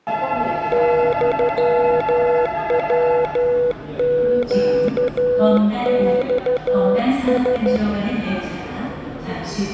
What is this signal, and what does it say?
Morse code (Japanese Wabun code), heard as a keyed tone, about 13 wpm, 490 Hz, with the noise of a subway station. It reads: ユヤネマラ